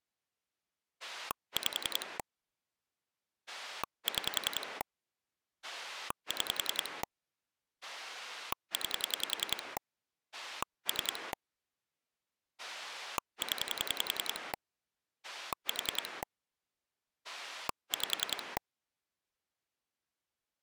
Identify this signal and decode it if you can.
Pulse dialling, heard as a rotary dial, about 10 pulses a second. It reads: 5 6 6 9 3 0 4 5